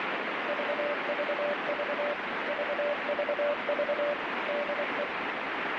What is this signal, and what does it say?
Morse code, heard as a keyed tone, machine-sent, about 24 wpm, 580 Hz, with heavy radio static. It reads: VVV VVV DE